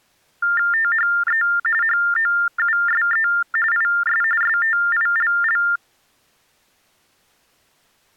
TTY/TDD text telephone tones (45.45 baud Baudot), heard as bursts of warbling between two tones, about 400 Hz shift, 1600 Hz centre. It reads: THE HOUSE IS STILL